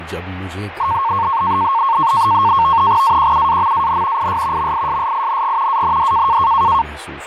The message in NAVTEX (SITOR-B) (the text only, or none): AQUAMAN IS MISSING AND